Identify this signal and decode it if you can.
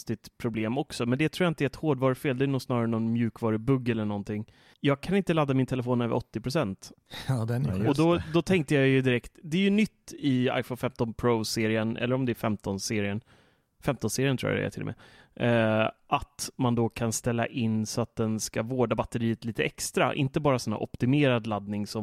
Speech in Swedish. There is no code.